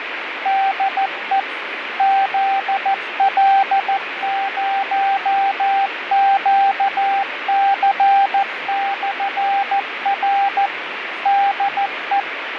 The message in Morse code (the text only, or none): DE ZL0QC/R DE